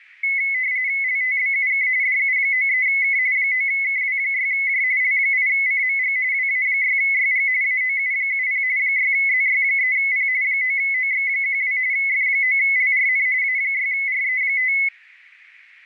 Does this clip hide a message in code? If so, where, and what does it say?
Yes: RTTY (45.45 baud, 170 Hz shift) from 0.2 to 14.9 s, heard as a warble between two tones, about 2100 Hz centre. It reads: LTBUK DU93K 9KW6J L8CMG WA6YG AOU70 6ZY3P 9OX12 F9LRN A6RE5